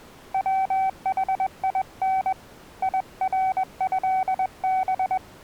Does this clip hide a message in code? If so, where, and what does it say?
Yes: Morse code (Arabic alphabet) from 0.3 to 5.2 s, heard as a keyed tone, hand-sent with a paddle, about 21 wpm, 760 Hz. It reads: وحين يرهب